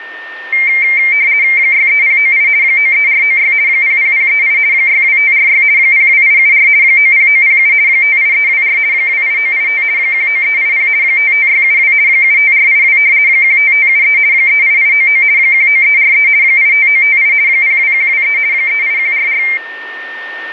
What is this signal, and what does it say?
RTTY (50 baud, 170 Hz shift), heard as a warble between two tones, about 2200 Hz centre, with a steady whistle near 1820 Hz. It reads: 63098 93496 00038 62546 02874 90907 58324 28985 19380 55672 75482 15573 38899 19343 85958 02123 38144